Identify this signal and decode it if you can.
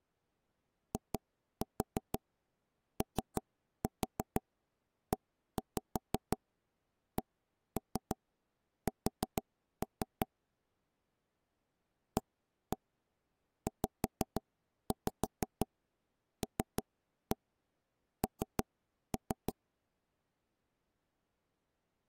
Tap code, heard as taps on a table, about 6 knocks a second. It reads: IOECS AZLN